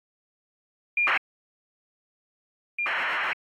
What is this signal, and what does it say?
ACARS aircraft data, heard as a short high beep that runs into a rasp, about 2400 baud.